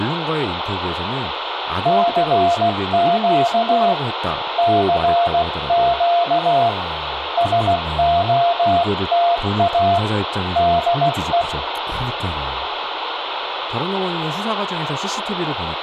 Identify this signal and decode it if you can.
Morse code, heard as a keyed tone, hand-sent with a paddle, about 16 wpm, 690 Hz, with radio static, room echo and speech in Korean. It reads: CQ CQ SOTA DE